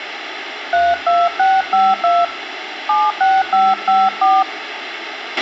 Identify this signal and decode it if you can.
DTMF, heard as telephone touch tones, dialled by hand, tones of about 210 ms, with radio hiss, a squelch burst at the end and room echo. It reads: 32652 76554